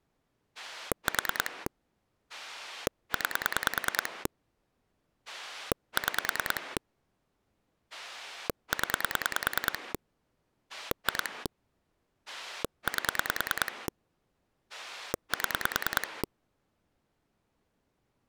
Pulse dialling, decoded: 4 9 6 0 2 8 7

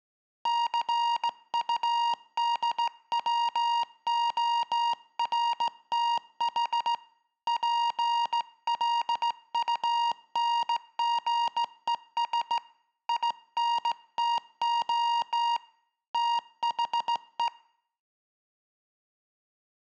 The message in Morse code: CUDWORTH PLUNGES INTO THE

